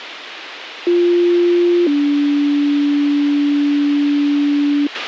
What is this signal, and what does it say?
Two-tone page, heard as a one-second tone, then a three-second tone, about 350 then 290 Hz, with radio hiss and a squelch burst at the end.